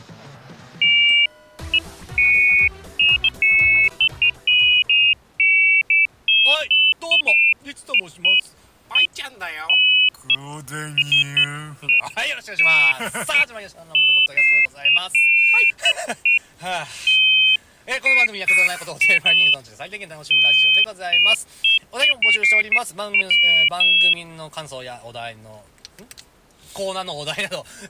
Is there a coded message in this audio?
No, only pairs of high tones at irregular times.